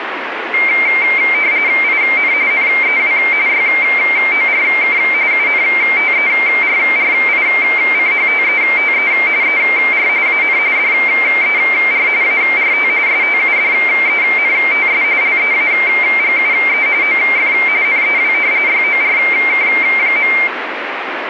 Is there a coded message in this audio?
Yes: RTTY (45.45 baud, 170 Hz shift) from 0.5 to 20.5 s, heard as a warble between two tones, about 2200 Hz centre, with radio static. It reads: IN NEW YORK UNTERRICHTETE ER AN DER ART STUDENTS LEAGUE OF NEW YORK.